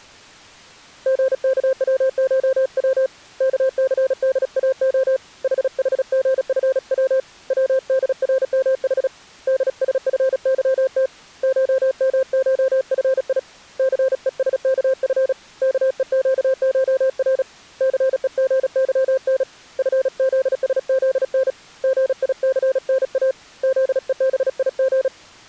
Morse code (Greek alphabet), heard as a keyed tone, hand-sent with a paddle, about 36 wpm, 530 Hz. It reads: ΓΚΩΧΩ ΚΘΔΑΟ ΗΗΓΦΩ ΩΔΡΜΗ ΔΣΦΥΤ ΧΜΧΦΙ ΘΕΣΚΦ ΚΕΨΧΡ ΘΕΓΥΝ ΦΖΣΖΝ ΓΙΘΝΑ ΖΕΒΙΓ